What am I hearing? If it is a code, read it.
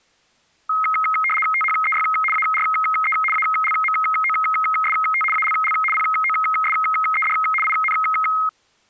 RTTY (75 baud, 850 Hz shift), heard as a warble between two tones, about 1700 Hz centre. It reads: THEY ARE ALMOST ALL POSED IN